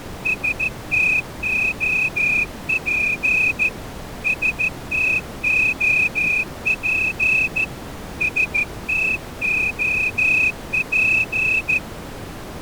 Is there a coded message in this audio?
Yes: Morse code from 0.2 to 11.8 s, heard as a whistle, hand-sent with a straight key, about 14 wpm. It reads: STOP STOP STOP